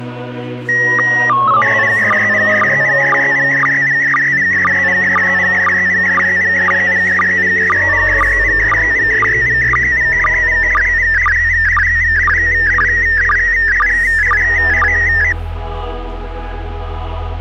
SSTV (slow-scan television), PD 120, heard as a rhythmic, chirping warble.